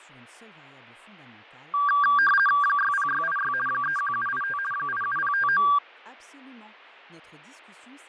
RTTY (50 baud, 450 Hz shift), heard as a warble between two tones, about 1380 Hz centre, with fading. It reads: 60686 31785 87059